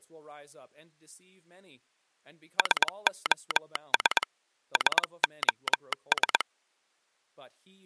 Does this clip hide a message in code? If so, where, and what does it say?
Yes: Morse code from 2.5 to 6.5 s, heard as a telegraph sounder, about 21 wpm. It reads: SOS SOS